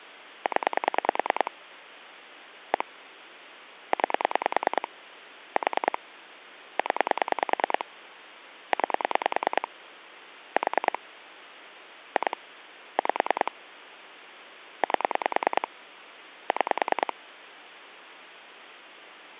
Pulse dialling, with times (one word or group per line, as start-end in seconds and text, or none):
0.5-1.5 0
2.7-2.8 1
3.9-4.9 9
5.6-6.0 4
6.8-7.8 0
8.7-9.7 9
10.6-11.0 4
12.2-12.4 2
13.0-13.5 5
14.8-15.7 8
16.5-17.1 6